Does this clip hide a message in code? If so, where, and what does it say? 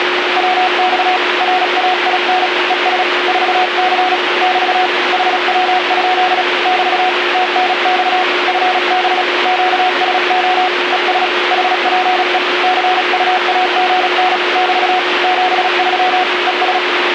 Yes: Morse code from 0.3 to 16.8 s, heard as a keyed tone, hand-sent with a paddle, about 36 wpm, 740 Hz, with radio static and a steady whistle near 360 Hz. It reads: WX RAIN ES 4C <BT> HW? <BT> TNX FB QSO ES HPE CUAGN <BT> 73 ES